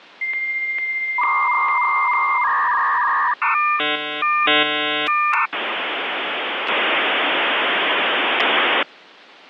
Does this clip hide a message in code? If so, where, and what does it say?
Yes: dial-up modem handshake (V.34 or later) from 0.2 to 8.8 s, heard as a whistle, warbles, then hiss.